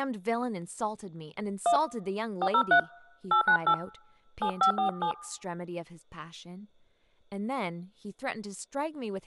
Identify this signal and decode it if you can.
DTMF, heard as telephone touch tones, dialled by hand, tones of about 90 ms, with speech in English. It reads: 1 403 898 7547